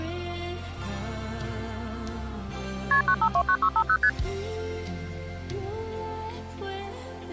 Multi-frequency trunk signalling (R1, as on North American trunks), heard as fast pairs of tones, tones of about 70 ms. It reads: KP 9529650 ST